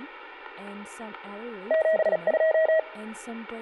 Morse code, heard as a keyed tone, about 37 wpm, 640 Hz, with room echo and speech in English. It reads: 72